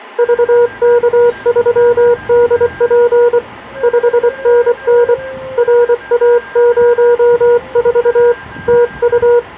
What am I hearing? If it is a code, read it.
Morse code, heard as a keyed tone, hand-sent with a paddle, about 24 wpm, 480 Hz, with a weaker station near 1600 Hz and street noise. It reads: VK3DP 5NN RA04 TU